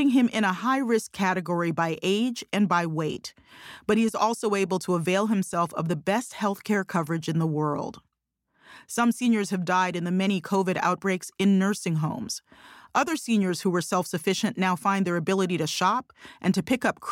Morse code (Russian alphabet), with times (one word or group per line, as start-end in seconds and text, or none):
none